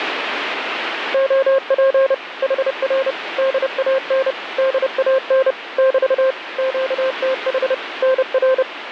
Morse code, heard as a keyed tone, machine-sent, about 30 wpm, 530 Hz, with radio static. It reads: OP HR DAN DAN <BT> QTH NR